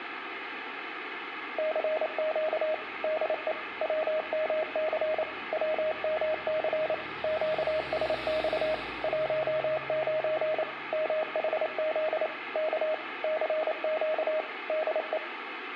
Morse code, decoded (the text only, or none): CQ DE WMC WMC QSX 19 MHZ K CQ DE